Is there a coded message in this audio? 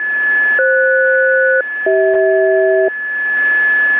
Yes: aircraft SELCAL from 0.6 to 2.9 s, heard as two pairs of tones, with a steady whistle near 1720 Hz. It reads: FS-CH